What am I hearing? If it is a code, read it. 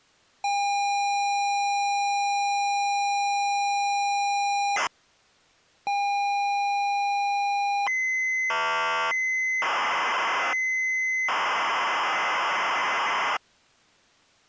ZX Spectrum tape loading, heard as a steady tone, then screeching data.